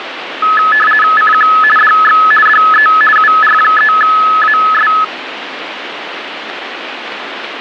RTTY (50 baud, 450 Hz shift), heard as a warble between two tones, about 1500 Hz centre, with radio static. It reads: CQ DX DE UR3AS